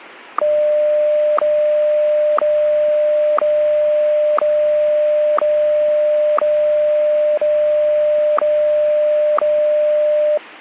Radio time signal (WWVH, Hawaii), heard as ticks, one a second.